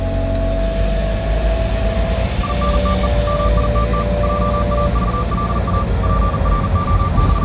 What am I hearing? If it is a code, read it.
Morse code, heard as a keyed tone, machine-sent, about 40 wpm, 1180 Hz, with the noise inside a car. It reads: INTE MITT JAVLA …